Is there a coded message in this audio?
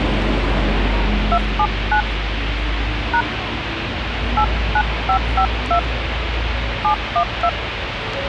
Yes: DTMF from 1.3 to 7.5 s, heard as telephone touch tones, dialled by hand, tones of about 90 ms, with phone line noise and street noise. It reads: 279 # 89552 712